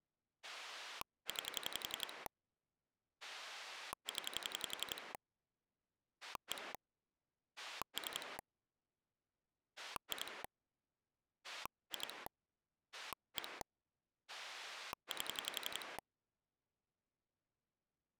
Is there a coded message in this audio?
Yes: pulse dialling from 0.4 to 16.0 s, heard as a rotary dial, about 11 pulses a second. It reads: 9 0 1 3 2 2 1 8